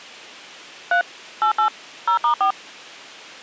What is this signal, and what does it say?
DTMF, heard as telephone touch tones, dialled by machine, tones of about 100 ms. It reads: 3 88 0*4